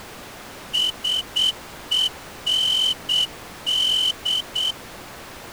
Morse code, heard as a whistle, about 8 wpm. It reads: SEND